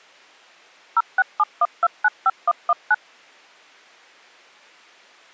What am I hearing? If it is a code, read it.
DTMF, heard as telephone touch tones, dialled by machine, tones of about 40 ms. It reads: 0671295119